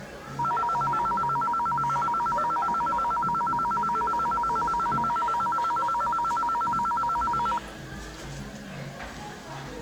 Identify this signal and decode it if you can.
A tone that alternates evenly between two pitches, with the noise of a crowd indoors. There is no code.